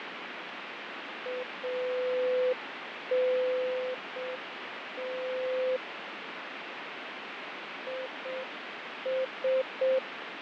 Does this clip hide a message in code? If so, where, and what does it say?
Yes: Morse code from 1.2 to 10.0 s, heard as a keyed tone, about 6 wpm, 510 Hz, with radio static and fading. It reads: ANT IS